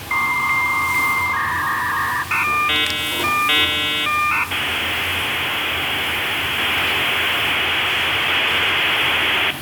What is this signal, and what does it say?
Dial-up modem handshake (V.34 or later), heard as a whistle, warbles, then hiss, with phone line noise, room echo and the noise of a restaurant.